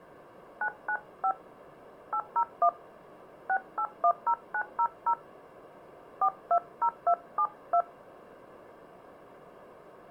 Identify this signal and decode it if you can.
DTMF, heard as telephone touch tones, dialled by hand, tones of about 70 ms. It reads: 995 801 6810900 420272